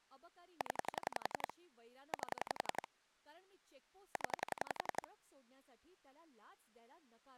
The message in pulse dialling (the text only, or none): 0 8 0